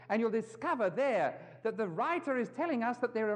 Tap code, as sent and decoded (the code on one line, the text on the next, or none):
none